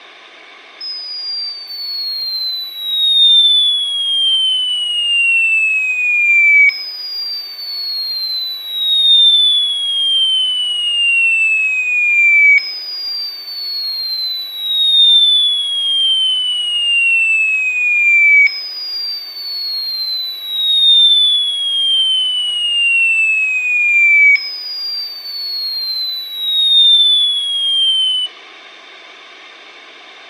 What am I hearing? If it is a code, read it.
A tone that sweeps in pitch again and again. There is no code.